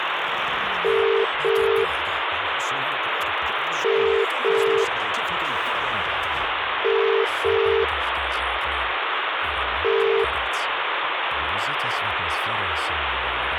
Telephone call progress tone (as in the UK, Ireland, Australia and similar networks), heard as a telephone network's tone, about 400, 450 Hz, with phone line noise. Ringback tone.